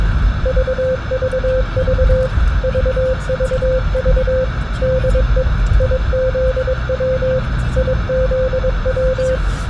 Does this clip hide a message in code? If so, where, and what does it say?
Yes: Morse code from 0.4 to 9.4 s, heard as a keyed tone, machine-sent, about 22 wpm, 520 Hz, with radio hiss and the noise inside a car. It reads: VVV VVV DE IZW IZW